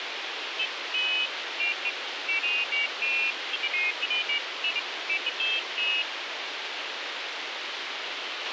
Pairs of high tones at irregular times, with radio hiss and a squelch burst at the end. There is no code.